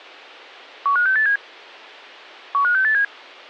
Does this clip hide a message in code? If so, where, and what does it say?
Yes: five-tone selective call (CCIR) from 0.9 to 3.0 s, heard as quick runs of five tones, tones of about 100 ms, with a squelch burst at the end. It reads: 15687 15687